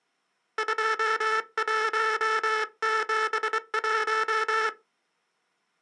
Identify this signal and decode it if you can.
Morse code, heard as a buzzer, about 24 wpm. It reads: 2171